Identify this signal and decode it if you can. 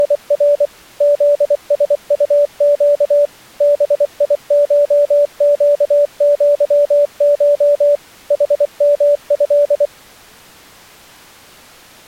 Morse code (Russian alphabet), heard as a keyed tone, machine-sent, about 24 wpm, 580 Hz. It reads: … ЗСУЩ БИШЩЪШ ХМЭ